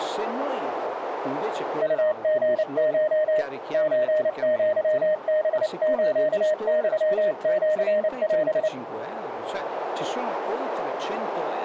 Morse code (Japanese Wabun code), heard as a keyed tone, hand-sent with a paddle, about 29 wpm, 620 Hz, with radio static and a narrow filter. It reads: ウリコ ソアハスユシオ